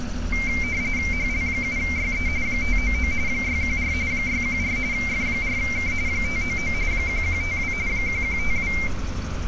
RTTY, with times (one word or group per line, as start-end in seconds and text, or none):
1.1-2.3 HL7YE
2.5-3.1 599
3.3-3.9 614
4.1-4.8 614
4.9-5.9 F4K
6.1-6.7 599
6.9-7.7 1152
7.9-8.7 1152